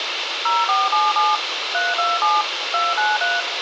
DTMF, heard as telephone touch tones, dialled by machine, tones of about 190 ms, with radio hiss and room echo. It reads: 0477 327 293